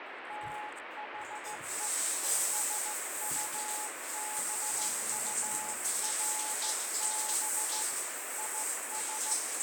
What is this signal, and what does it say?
Morse code, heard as a keyed tone, hand-sent with a straight key, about 15 wpm, 850 Hz, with heavy radio static and the noise of a restroom. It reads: THE SUBURB IS